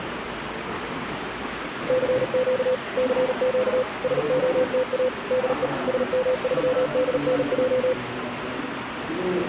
Morse code, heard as a keyed tone, machine-sent, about 38 wpm, 510 Hz, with radio static and the noise of a subway station. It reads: CQ CQ SOTA DE SM3DNJ